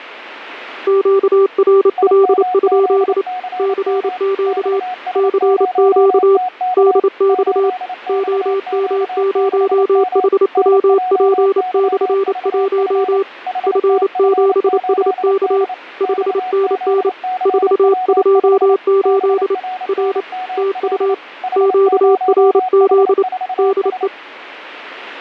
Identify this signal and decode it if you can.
Morse code, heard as two keyed tones. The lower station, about 28 wpm, 390 Hz: QRL? CQ CQ DX OM0HWP/1 F7SK 5NN 428 R TU QRZ DE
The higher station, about 28 wpm, 740 Hz: IMZCM XS0TK 8XQ6M NJYVF HTF8D XZCW5 BRNML H0H4S